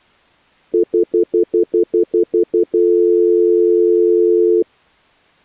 Telephone call progress tone (North American plan), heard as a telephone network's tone, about 350, 440 Hz, 0.1 s on and 0.1 s off. Stutter dial tone.